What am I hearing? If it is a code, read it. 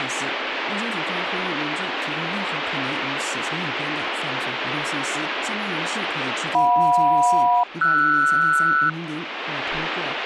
Aircraft SELCAL, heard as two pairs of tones, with radio static. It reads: JM-RS